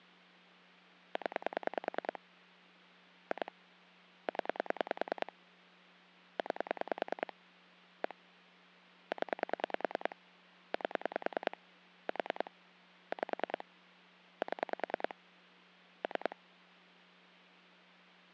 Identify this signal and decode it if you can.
Pulse dialling, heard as clicks on a phone line, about 10 pulses a second, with hum. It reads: 0 2 0 9 1 0 8 4 5 7 3